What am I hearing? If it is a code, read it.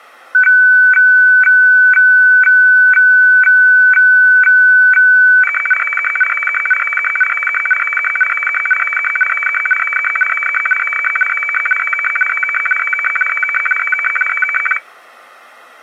Weather fax (radiofax), 120 lines a minute, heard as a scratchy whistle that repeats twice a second.